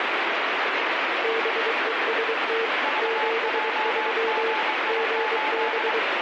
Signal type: Morse code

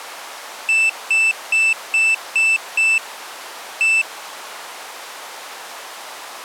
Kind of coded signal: beep code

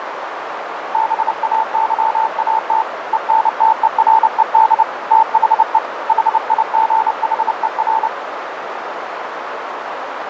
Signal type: Morse code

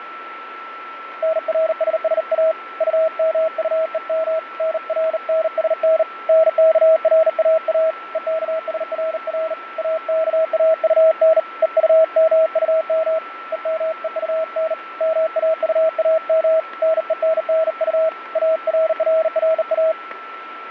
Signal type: Morse code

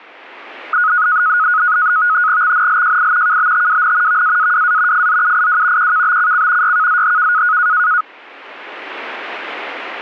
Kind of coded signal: NAVTEX (SITOR-B)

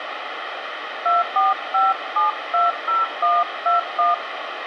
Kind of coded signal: DTMF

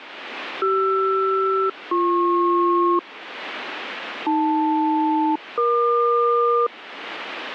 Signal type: aircraft SELCAL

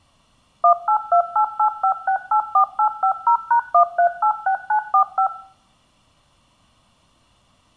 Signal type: DTMF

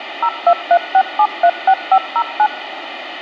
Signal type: DTMF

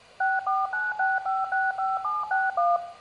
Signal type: DTMF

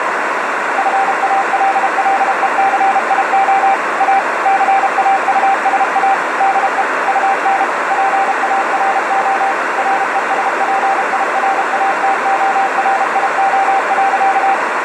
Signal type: Morse code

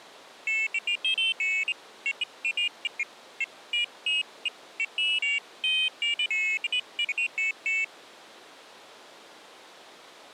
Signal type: none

